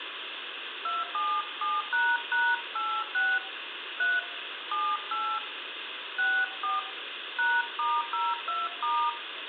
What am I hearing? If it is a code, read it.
DTMF, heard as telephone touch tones, dialled by hand, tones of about 210 ms, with phone line noise and room echo. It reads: 277##86 3 78 64 #*02*